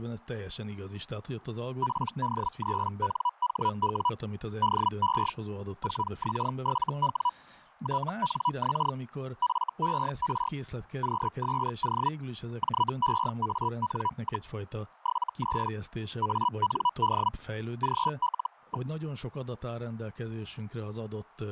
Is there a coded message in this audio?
Yes: Hellschreiber (Feld-Hell, 122.5 baud) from 1.8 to 18.9 s, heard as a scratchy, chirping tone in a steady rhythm, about 980 Hz, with fading and speech in Hungarian. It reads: PD3NHW DE 4X7W TNX FER QSO JEAN, 73 AND GL.